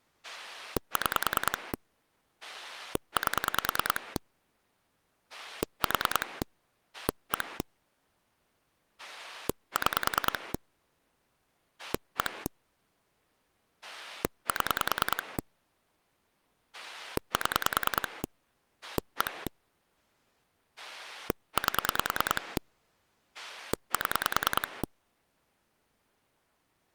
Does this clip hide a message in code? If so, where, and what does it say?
Yes: pulse dialling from 0.2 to 24.8 s, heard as a rotary dial, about 10 pulses a second. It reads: 6 8 4 1 6 1 7 7 1 8 7